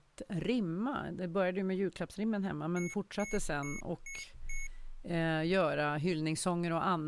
Beep code, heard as beeps from a small speaker, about 2200 Hz, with speech in Swedish. 5 short. In AMI BIOS tables: processor failure; in Dell tables: CMOS battery failure.